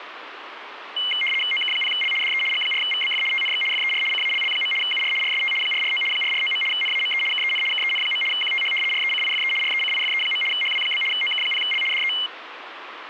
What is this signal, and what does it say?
RTTY (75 baud, 850 Hz shift), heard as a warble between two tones, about 2550 Hz centre, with radio static. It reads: OK0L DE G4VBF TNX FER CALL. UR RST 449 449. NAME KEN KEN. QTH RECIFE RECIFE. HW? OK0L DE